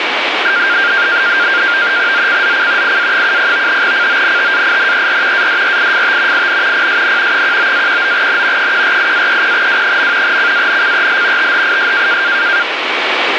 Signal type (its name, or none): NAVTEX (SITOR-B)